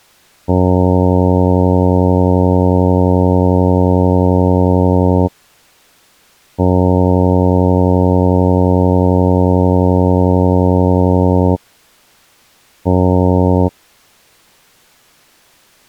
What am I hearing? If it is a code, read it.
Ship horn signal, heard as a ship's horn, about 90 Hz. 2 long, 1 short. At sea: I intend to overtake on your starboard side.